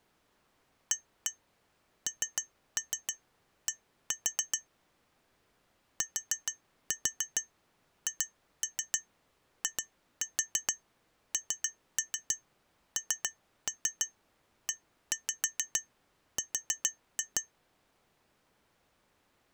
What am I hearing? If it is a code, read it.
Tap code, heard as taps on glass, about 7 knocks a second. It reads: AND THINNER